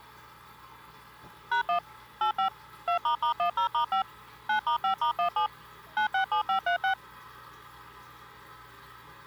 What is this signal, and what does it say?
DTMF, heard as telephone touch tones, dialled by machine, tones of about 100 ms, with the noise of a restroom. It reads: #1 85 2**10*5 9*5*17 967536